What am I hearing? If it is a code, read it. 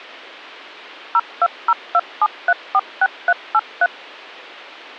DTMF, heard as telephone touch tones, dialled by machine, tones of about 50 ms. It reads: 02027346383